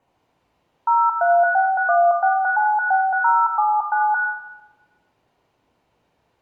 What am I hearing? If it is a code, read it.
DTMF, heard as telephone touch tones, dialled by machine, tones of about 230 ms, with room echo. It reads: 0361696079